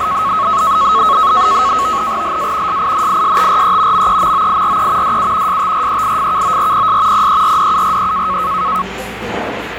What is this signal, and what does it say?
NAVTEX (SITOR-B), 100 baud, 170 Hz shift, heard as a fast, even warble, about 1190 Hz centre, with radio static and the noise of a cafe. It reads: LA SINISTRE MEMOIRE DU STREIFKORPS PERDURE